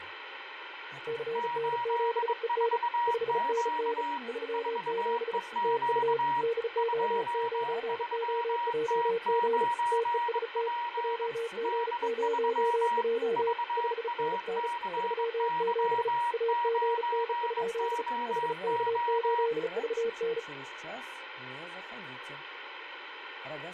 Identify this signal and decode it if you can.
Morse code, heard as two keyed tones, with radio static and speech in Russian. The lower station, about 35 wpm, 460 Hz: CN7EN 5NN 37 TU DO9OJG TEST JG0J 5NN 37 AGN? HK8VN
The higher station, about 22 wpm, 950 Hz: 84Q 4EQ 23T9P D3 VACY9OO